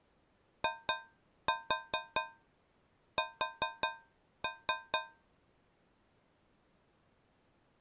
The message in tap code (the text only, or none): IS